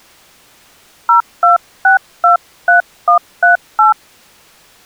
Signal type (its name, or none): DTMF